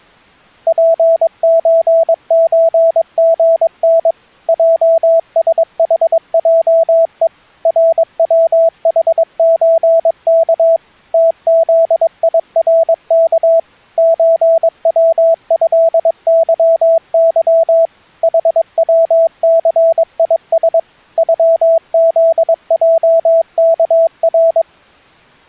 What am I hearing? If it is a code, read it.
Morse code (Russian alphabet), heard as a keyed tone, machine-sent, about 22 wpm, 660 Hz. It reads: ПЧЧГН ЙСХЙЕ РВХЧК ТЗИРК ЧВЭЫЫ ХВЦИС ЮЗЙКР